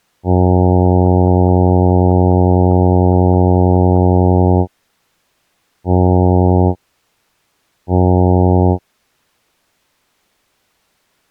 Ship horn signal, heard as a ship's horn, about 90 Hz. 1 long, 2 short. At sea: a vessel in fog that is sailing, fishing, towing or hampered.